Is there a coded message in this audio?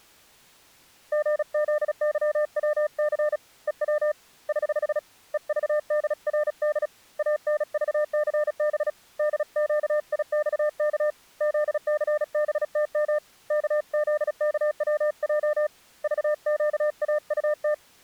Yes: Morse code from 1.1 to 17.8 s, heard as a keyed tone, hand-sent with a paddle, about 36 wpm, 600 Hz. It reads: GZYWC EW <HH> EVDRD ANVCB DQIXK ZCBTM KZKWJ VQAUT